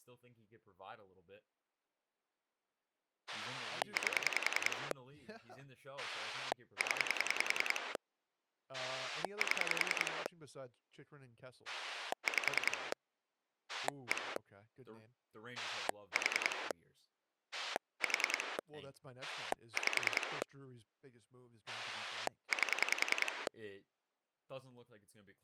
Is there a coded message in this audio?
Yes: pulse dialling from 3.3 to 23.5 s, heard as a rotary dial, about 10 pulses a second, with speech in English. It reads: 8 0 7 5 1 4 4 5 8